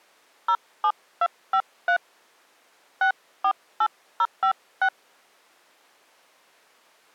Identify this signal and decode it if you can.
DTMF, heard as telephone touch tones, dialled by hand, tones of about 80 ms. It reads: 07253 648056